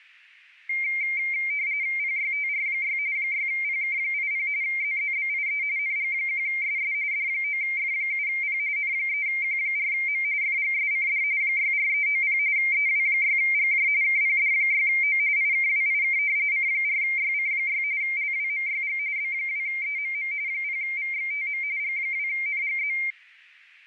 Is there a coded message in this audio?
Yes: RTTY (45.45 baud, 170 Hz shift) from 0.7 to 23.1 s, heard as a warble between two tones, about 2200 Hz centre. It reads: PYTR6 6PK80 ZZBIE NG1SS D9F7P N3Q4M FGSCD 64390 EW6GJ KPD6O IKWIK C4YC6 LWMYG B2EMM 0VXTM G2NGZ